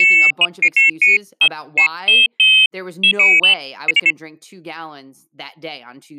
Pairs of high tones at irregular times, with speech in English. There is no code.